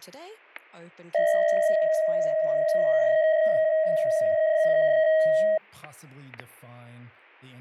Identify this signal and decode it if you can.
PSK63 (62.5 baud), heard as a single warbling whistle, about 630 Hz, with static crashes and speech in English.